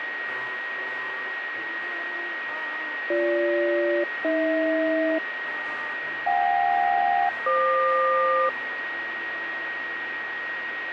Aircraft SELCAL, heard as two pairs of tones, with radio static and a steady whistle near 1890 Hz. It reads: BG-AH JK-FQ